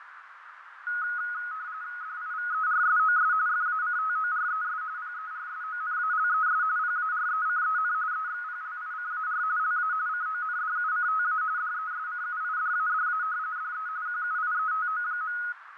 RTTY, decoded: DIVERSOS FACTORES PERSONALES PARECEN EXPLICAR LA CONDUCTA DESCUIDADA DE QUIETO.

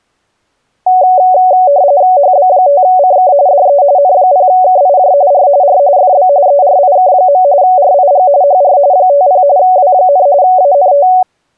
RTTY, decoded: HB5CK DE N0KIJ R R FB ERIK. RIG HR 50 W, ANT

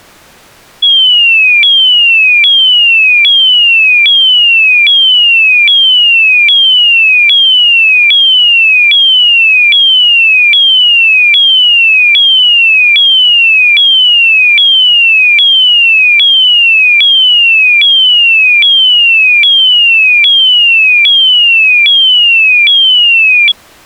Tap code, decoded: none

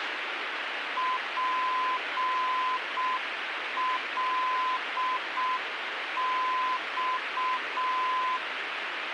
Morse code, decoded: PLX

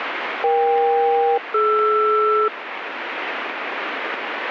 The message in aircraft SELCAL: EK-DR

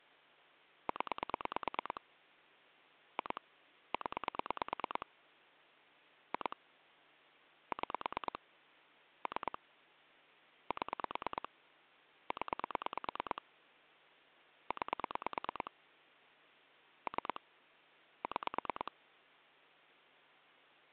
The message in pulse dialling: 0 2 0 2 6 3 7 0 9 3 6

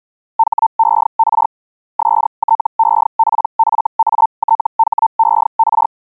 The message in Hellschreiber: HER STEPFATHER

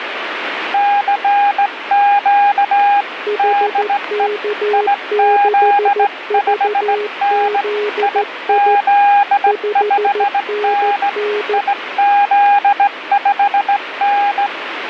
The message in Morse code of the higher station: CQ DE IZ5N IZ5N IZ5N

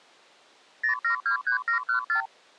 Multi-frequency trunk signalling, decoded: 0723714

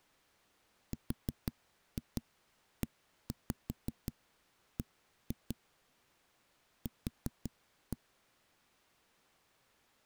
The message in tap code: REB Q

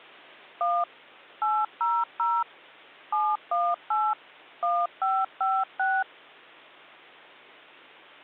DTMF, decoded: 1 800 718 1556

